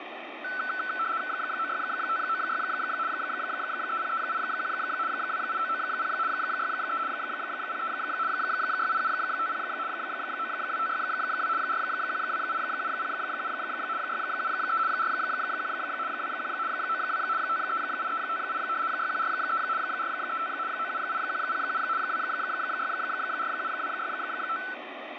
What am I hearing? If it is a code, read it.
RTTY (75 baud, 170 Hz shift), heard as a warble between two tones, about 1420 Hz centre, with radio static. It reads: 96596 30381 28990 63 03 68750 92562 4128707 673 41 21 92 538358 6143 435 978107 2647265